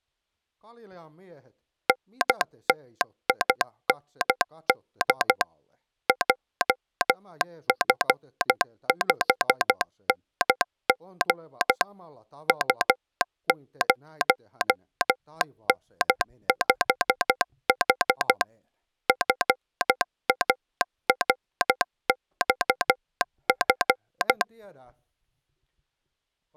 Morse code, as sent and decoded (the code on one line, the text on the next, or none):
-. - .. -. -.. / .--- ..-. ..... -. --. / ..- ----- -. ..... .... / ..-. .- .-. -..- ..-.
NTIND JF5NG U0N5H FARXF